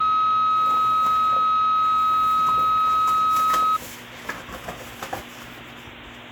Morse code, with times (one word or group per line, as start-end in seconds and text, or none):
none